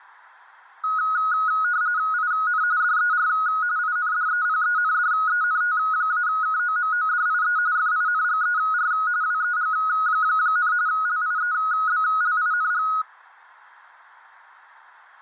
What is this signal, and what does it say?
RTTY (45.45 baud, 170 Hz shift), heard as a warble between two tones, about 1360 Hz centre. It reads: IN DER INDEPENDENT-KOMODIE FINGER WEG, LIEBLING